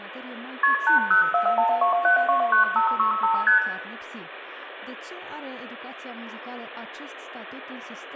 Multi-frequency trunk signalling (R1, as on North American trunks), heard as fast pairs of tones, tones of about 120 ms, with room echo and speech in Romanian. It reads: KP 80412729565 ST